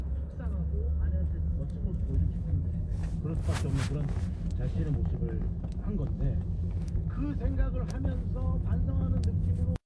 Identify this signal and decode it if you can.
The noise inside a car. There is no code.